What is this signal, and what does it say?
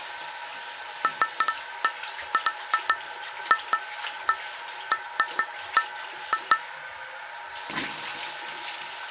Irregular taps on glass, with the noise of a restroom. There is no code.